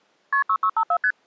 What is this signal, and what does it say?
Multi-frequency trunk signalling (R1, as on North American trunks), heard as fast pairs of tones, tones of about 70 ms. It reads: KP 6654 ST